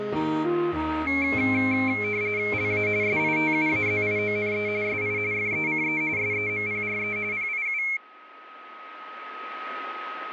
RTTY (45.45 baud, 170 Hz shift), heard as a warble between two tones, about 2250 Hz centre, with radio static and a steady whistle near 1270 Hz. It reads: LA SITUAZIONE SI FECE SEMPRE PIU